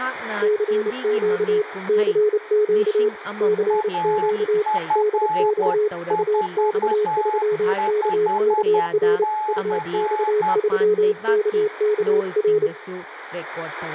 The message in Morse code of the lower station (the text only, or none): CQ CQ CQ DX UX3KKR UX3KKR